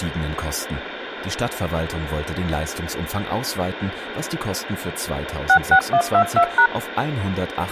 DTMF, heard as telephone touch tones, dialled by machine, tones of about 80 ms, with phone line noise. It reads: 66122#